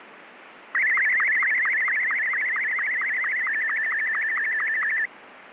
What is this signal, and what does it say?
SSTV (slow-scan television), Martin M2, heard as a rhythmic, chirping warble, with radio static.